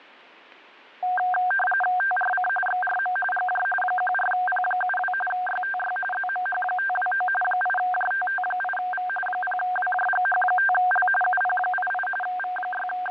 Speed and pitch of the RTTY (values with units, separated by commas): 45.45 baud, 850 Hz shift, 1160 Hz centre